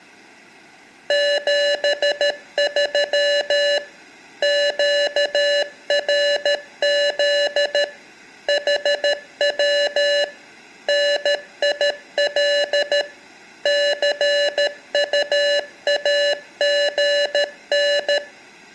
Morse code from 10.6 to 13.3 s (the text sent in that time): NIL